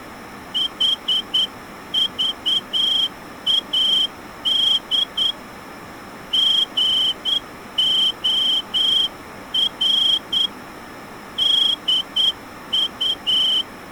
Morse code, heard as a whistle, hand-sent with a straight key, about 9 wpm. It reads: HVAD GOR DU